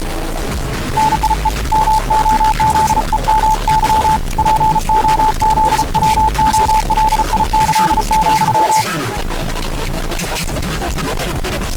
Morse code (with Polish letters), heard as a keyed tone, hand-sent with a paddle, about 35 wpm, 870 Hz. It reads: NIE MOZEMY POZWOLIĆ,